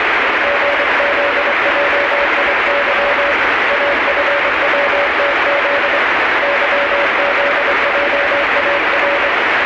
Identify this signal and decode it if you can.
Morse code, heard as a keyed tone, hand-sent with a straight key, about 24 wpm, 570 Hz, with heavy radio static and the noise of a subway station. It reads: GZJIY AFWTZ YZJAR